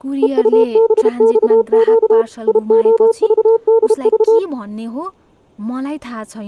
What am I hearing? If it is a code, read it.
Morse code, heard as a keyed tone, machine-sent, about 32 wpm, 450 Hz, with speech in Nepali. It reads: EUBXQ IOVDV